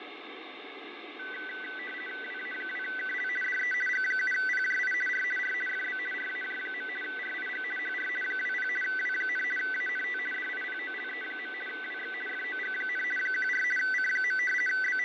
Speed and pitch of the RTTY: 50 baud, 450 Hz shift, 1750 Hz centre

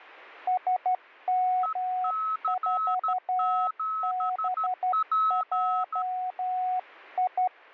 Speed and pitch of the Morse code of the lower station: 12 wpm, 740 Hz

